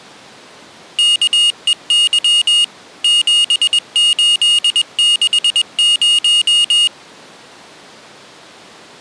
Morse code, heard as a high beeper, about 21 wpm, 2850 Hz. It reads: KEY 7860